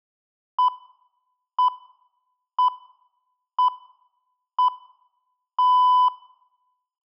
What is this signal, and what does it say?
Radio time signal (six pips, as the Greenwich Time Signal), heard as pips.